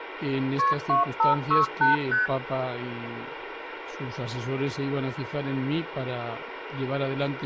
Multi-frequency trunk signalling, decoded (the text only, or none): KP 2568 ST